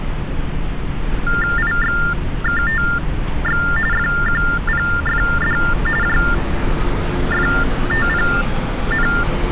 TTY/TDD text telephone tones (45.45 baud Baudot), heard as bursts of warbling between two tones, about 400 Hz shift, 1600 Hz centre, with phone line noise and street noise. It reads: IXKTX FQPFD JFTPN